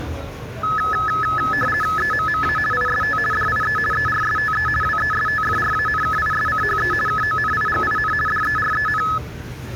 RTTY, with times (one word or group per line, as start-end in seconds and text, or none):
2.0-2.6 EMMA
2.7-3.2 IST
3.3-3.8 DIE
3.9-4.7 ERSTE
4.8-6.9 WESTFRANKISCHE
7.1-8.1 KONIGIN
8.3-9.0 DEREN